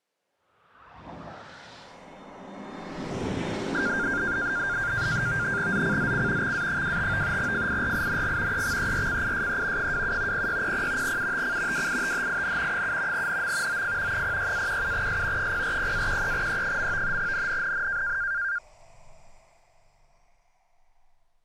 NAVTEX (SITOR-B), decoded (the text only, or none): ZCZC XA25 FIRING EXERCISE 27 0600 UTC WITHIN 7 NM OF 06-17S 040-13E. NNNN